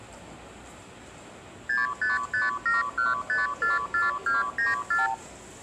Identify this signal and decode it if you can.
Multi-frequency trunk signalling (R2, with the far end's replies), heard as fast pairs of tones, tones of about 160 ms, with the noise of a subway station. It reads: 65571544294